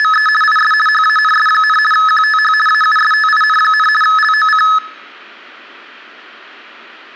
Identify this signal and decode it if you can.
RTTY (50 baud, 450 Hz shift), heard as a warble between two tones, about 1500 Hz centre. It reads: … IS HANS, QTH AUSTIN, LOC